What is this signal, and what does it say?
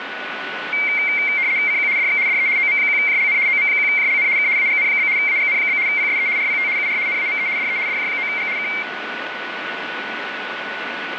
RTTY (75 baud, 170 Hz shift), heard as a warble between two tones, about 2200 Hz centre, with radio static and a steady whistle near 1480 Hz. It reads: CQ DX DE OM1JLN OM1JLN K AGN? AGN? PSE RPT UR NAME DE DJ9G K